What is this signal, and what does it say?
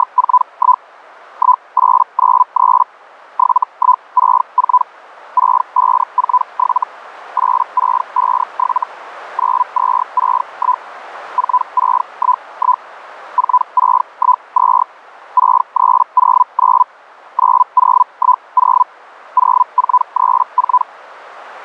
Hellschreiber (Feld-Hell, 122.5 baud), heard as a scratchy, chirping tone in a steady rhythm, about 1000 Hz, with radio static. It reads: … 1893 7164 6547 8657 9261 4611 4612 6309 9010 0434